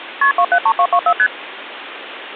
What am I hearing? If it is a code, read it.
Multi-frequency trunk signalling (R1, as on North American trunks), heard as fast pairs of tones, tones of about 70 ms, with phone line noise. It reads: KP 273224 ST